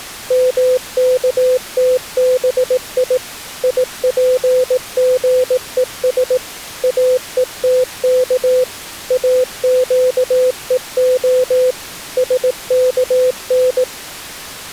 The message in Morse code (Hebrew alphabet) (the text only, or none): מכתבי יפגוש אותך אקוה שכן